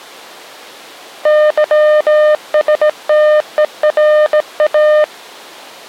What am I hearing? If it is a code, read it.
Morse code (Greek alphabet), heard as a keyed tone, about 17 wpm, 610 Hz. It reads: ΥΣΤΕΡΑ